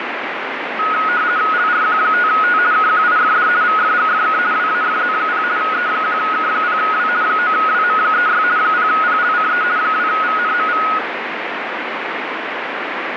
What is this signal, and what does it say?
RTTY (50 baud, 170 Hz shift), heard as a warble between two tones, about 1360 Hz centre, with radio static. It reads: LRQ5T KQIFD VFGFK WAFZ0 E1K0W 9WM36 0PLCE 2VNMV